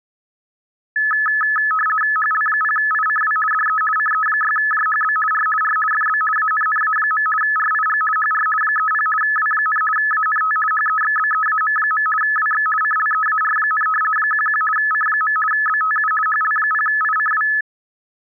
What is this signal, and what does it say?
RTTY (50 baud, 450 Hz shift), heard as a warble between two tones, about 1500 Hz centre. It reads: HL0ICW DE CE6JHB R R FB ANNA. RIG HR 30 W, ANT HEXBEAM. WX CLEAR, 11 C. BTU HL0ICW